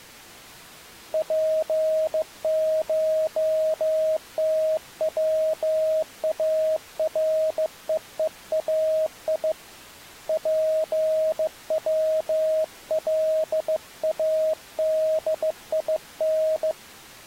Morse code (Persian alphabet), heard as a keyed tone, hand-sent with a bug key, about 15 wpm, 630 Hz. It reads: پشتوارههای پولادین